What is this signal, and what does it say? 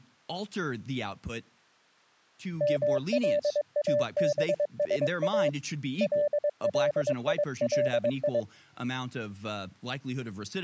Morse code (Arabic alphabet), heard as a keyed tone, hand-sent with a paddle, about 22 wpm, 590 Hz, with speech in English. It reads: ملابسا لليلي